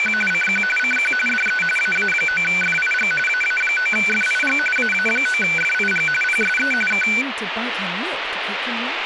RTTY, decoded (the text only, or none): … CQ CQ DE AA9FIG AA9FIG AA9FIG PSE K